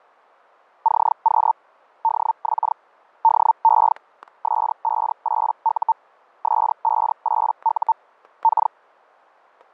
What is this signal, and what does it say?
Hellschreiber (Feld-Hell, 122.5 baud), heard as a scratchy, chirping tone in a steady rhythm, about 900 Hz, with static crashes. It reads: CQ DX DE S58U S58U K